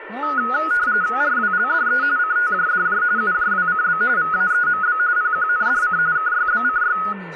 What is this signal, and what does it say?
RTTY (45.45 baud, 170 Hz shift), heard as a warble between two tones, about 1360 Hz centre, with radio static, a steady whistle near 1780 Hz and speech in English. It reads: RWLDE CTJDJ UJWCB VAEMB PQNDC KYBCY